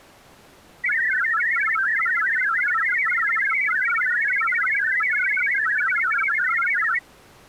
Multi-tone FSK (Olivia or MFSK type), about 1000 Hz wide, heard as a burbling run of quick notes, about 62.5 baud.